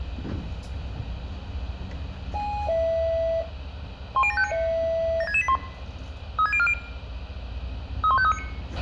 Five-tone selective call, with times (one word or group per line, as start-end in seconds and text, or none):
4.2-4.5 10759
5.2-5.6 76681
6.4-6.7 36040
8.0-8.4 31539